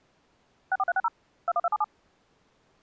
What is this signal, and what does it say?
DTMF, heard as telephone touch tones, dialled by machine, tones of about 40 ms. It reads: 64360 21277